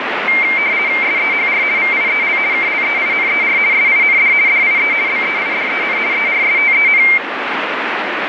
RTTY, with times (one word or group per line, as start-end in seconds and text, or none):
1.0-1.6 SEHR
1.8-2.4 VIEL
2.5-3.6 KLEINER
3.7-4.3 SIND
4.5-4.9 DIE
5.1-6.0 BEIDEN
6.1-7.0 ERSTEN